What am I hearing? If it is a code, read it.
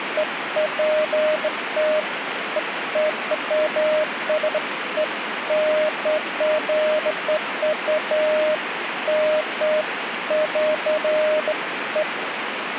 Beeps of irregular length, with radio static. There is no code.